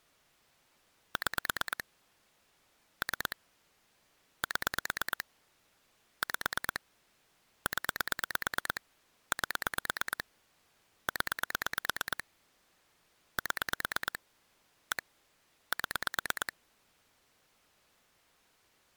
Pulse dialling, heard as clicks on a phone line, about 9 pulses a second. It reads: 6 3 7 5 0 8 0 7 1 7